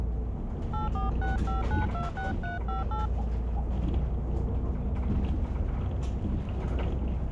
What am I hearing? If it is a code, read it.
DTMF, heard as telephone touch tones, dialled by hand, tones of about 150 ms, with the noise inside a bus. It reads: 8465926358